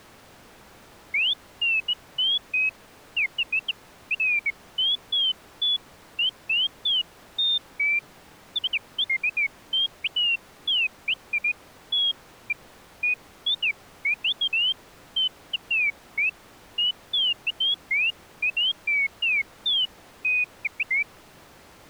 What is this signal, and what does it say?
Bird-like chirps. There is no code.